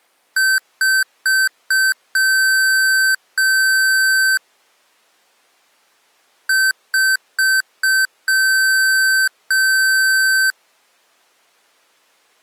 Beep code, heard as beeps from a small speaker, played twice, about 1550 Hz. 4 short, 2 long.